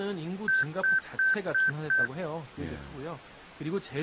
Beep code, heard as beeps from a small speaker, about 1550 Hz, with speech in Korean. 5 short. In AMI BIOS tables: processor failure; in Dell tables: CMOS battery failure.